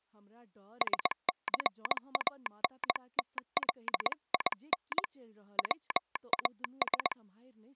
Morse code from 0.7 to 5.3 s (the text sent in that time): SCANTLIN